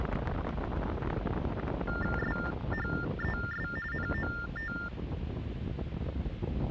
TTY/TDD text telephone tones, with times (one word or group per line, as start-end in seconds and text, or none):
2.2-3.7 SHES
3.9-4.7 NOT